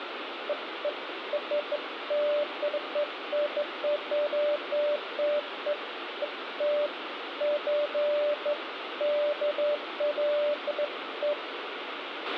Beeps of irregular length, with radio hiss, a squelch burst at the end and room echo. There is no code.